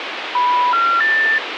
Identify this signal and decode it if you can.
Telephone call progress tone (North American plan), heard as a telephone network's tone, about 980, 1370, 1800 Hz, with phone line noise. Special information tone.